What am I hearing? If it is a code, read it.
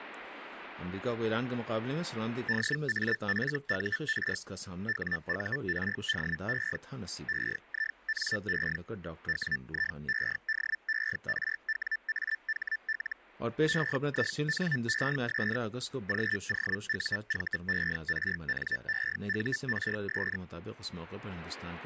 Hellschreiber (Feld-Hell, 122.5 baud), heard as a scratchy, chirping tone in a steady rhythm, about 1750 Hz. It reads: DAFUR WURDE EINE WIEDERWAHL EINES GOUVERNEURS